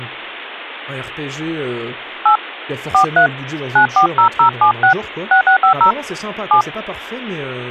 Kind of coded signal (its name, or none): DTMF